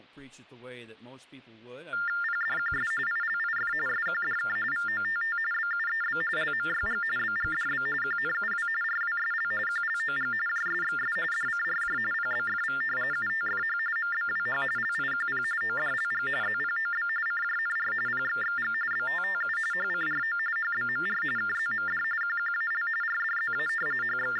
TTY/TDD text telephone tones (45.45 baud Baudot), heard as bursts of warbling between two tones, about 400 Hz shift, 1600 Hz centre. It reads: PDQS ILIF SQDK VOTT BUEB LMYG BGDB QNUW RWSL QLOG JSXS DCRJ PBFV UTFH MBWH LIQP ODLG ZPOB CJNR PXXG BTTU HCRO HBMR KZMD QQAL RDZA …